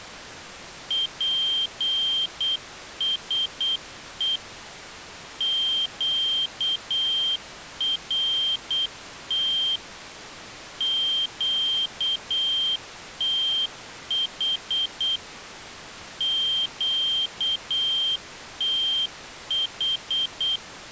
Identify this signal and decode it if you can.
Morse code, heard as a high beeper, machine-sent, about 8 wpm, 3150 Hz. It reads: PSE QRT QTH QTH